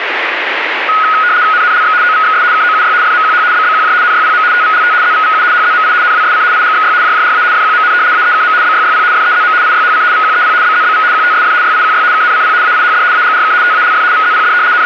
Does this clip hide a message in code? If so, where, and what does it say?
Yes: RTTY (75 baud, 170 Hz shift) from 0.9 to 14.9 s, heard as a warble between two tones, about 1360 Hz centre, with radio static. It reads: NNLX OVXS KOUY FMQH BBQJ NYPM TVLT ZVVU HZMI NWSC IGXY JJRA FQMN AEKM BYYP FEZM IYHC VQEP BZBV QTSF YIQY KNCP AIHD AGRK TALF VZPD …